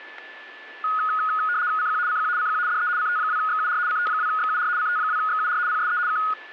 RTTY (75 baud, 170 Hz shift), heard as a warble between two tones, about 1350 Hz centre, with static crashes and a steady whistle near 1740 Hz. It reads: CQ CQ CQ DE CT2XUR CT2XUR CT2XUR PSE K